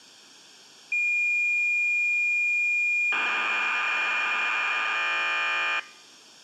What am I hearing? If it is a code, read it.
Cassette data (Kansas City type), 1200 baud, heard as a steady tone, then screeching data.